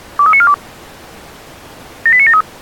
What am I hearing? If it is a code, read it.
Five-tone selective call (ZVEI), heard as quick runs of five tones, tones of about 70 ms. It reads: 23942 78973